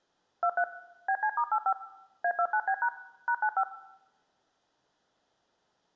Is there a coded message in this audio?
Yes: DTMF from 0.4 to 3.6 s, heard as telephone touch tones, dialled by machine, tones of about 70 ms, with room echo. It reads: 23 BC*85 A29B# #95